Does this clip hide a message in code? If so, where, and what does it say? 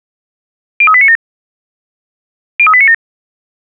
Yes: five-tone selective call (ZVEI) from 0.8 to 2.9 s, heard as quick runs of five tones, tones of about 70 ms. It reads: 03897 03897